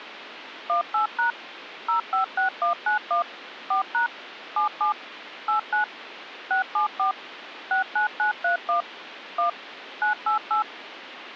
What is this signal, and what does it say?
DTMF, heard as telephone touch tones, dialled by machine, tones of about 120 ms, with phone line noise. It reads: 18# 056191 4# 77 89 674 69931 1 988